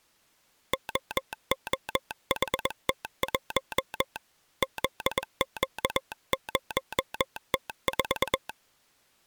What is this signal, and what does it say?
Morse code, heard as a telegraph sounder, hand-sent with a paddle, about 21 wpm. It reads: OOHT1 ZQ0T4